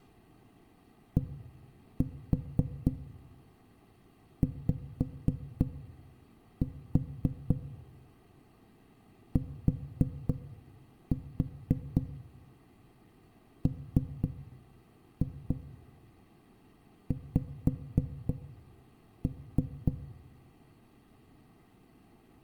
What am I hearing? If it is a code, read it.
Tap code, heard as knocks on a wall, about 3 knocks a second, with room echo. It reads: DYTMX